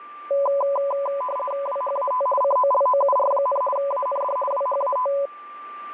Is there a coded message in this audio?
Yes: RTTY (50 baud, 450 Hz shift) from 0.3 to 5.3 s, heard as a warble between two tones, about 780 Hz centre, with a steady whistle near 1180 Hz. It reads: WHAT COLOUR, AND WHAT